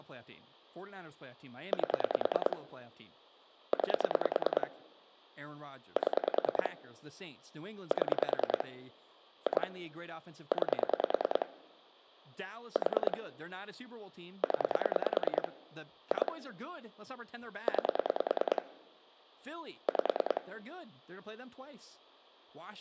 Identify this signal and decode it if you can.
Pulse dialling, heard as clicks on a phone line, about 10 pulses a second, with speech in English. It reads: 8 9 7 7 2 9 4 0 2 9 5